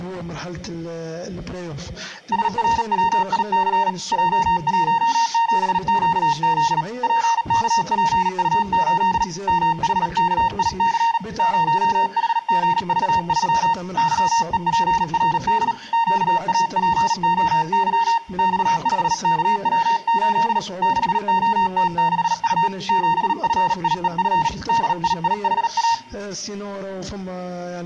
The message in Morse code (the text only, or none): SRWIC J17QZ PKPU8 MHKIC 0HGV3 YEPRD QAPOY X5KW8 6OT6U 7FIEF DIIHA